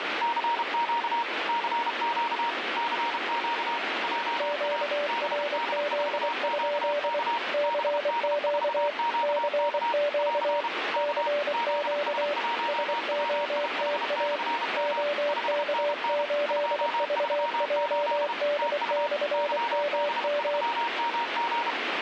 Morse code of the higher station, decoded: CQ CQ CQ JA BD4QK BD4QK <AR> K ZS1WIH/M 5NN 238 TU YB3MG

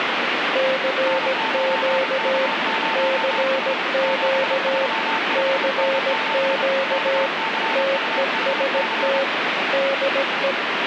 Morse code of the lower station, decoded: CQ CQ CQ TEST DE

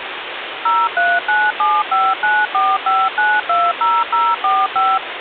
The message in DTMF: 03975945920045

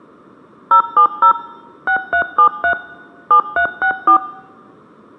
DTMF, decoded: 070 6373 7364

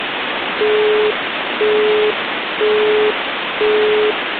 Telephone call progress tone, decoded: busy tone

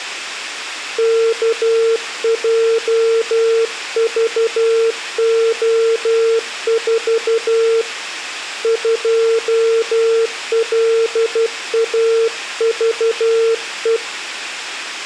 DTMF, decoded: none

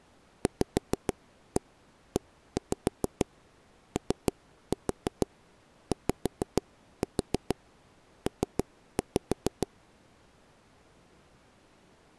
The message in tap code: VEOYP

